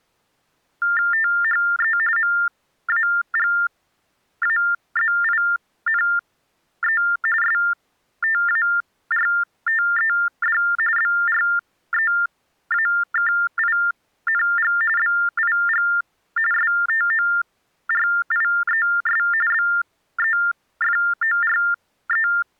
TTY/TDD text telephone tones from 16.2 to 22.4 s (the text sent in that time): STORIES BEFORE